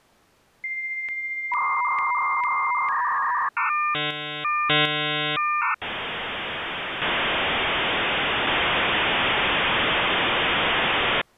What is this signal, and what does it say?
Dial-up modem handshake (V.34 or later), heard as a whistle, warbles, then hiss.